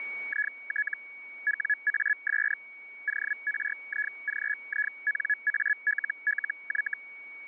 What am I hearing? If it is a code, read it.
Hellschreiber (Feld-Hell, 122.5 baud), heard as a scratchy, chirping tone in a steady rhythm, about 1700 Hz, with a steady whistle near 2240 Hz. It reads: IT WAS ORIGINALLY